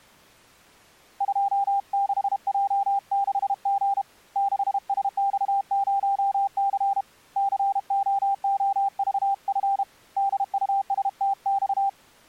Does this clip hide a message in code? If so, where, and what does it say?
Yes: Morse code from 1.1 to 12.0 s, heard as a keyed tone, hand-sent with a paddle, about 32 wpm, 790 Hz. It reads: 26J6G 6SX0C COOVF DUSTX